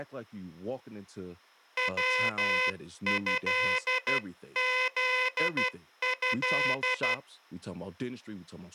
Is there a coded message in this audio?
Yes: Morse code (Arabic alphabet) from 1.7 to 7.2 s, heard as a buzzer, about 12 wpm, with speech in English. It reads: وهذه